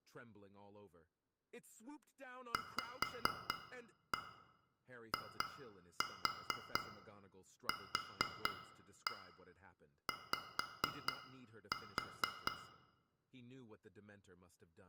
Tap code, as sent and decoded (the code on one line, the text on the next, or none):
5-1 2-4 4-1 5-4
VIQY